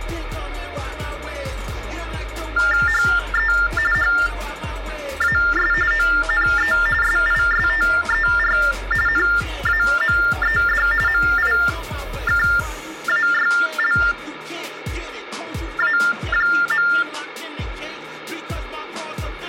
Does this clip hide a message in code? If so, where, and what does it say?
Yes: TTY/TDD text telephone tones (45.45 baud Baudot) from 2.6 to 17.0 s, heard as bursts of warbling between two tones, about 400 Hz shift, 1600 Hz centre, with phone line noise and room echo. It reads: HE HAS ONE SISTER NAMED MIKAYLA.